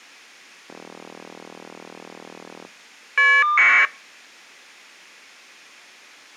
Caller ID data burst, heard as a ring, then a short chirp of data, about 1200 baud.